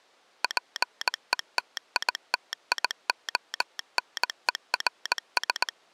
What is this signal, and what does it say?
Morse code, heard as a telegraph sounder, machine-sent, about 19 wpm. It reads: PETITIONERS